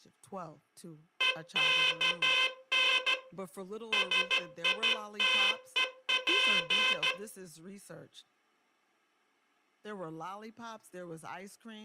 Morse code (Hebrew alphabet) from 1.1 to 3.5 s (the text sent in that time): וכן